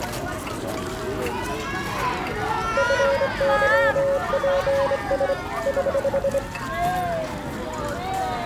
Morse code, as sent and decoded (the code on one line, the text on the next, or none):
..-. -.-- .--. ... / ........
FYPS <HH>